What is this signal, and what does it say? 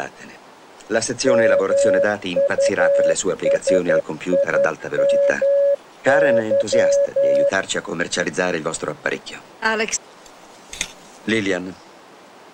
Morse code, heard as a keyed tone, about 11 wpm, 560 Hz. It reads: MUSIMY